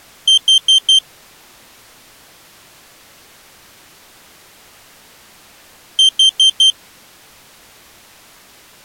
Alarm pattern, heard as an alarm's beeps, played twice, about 3150 Hz. Temporal four. Carbon monoxide.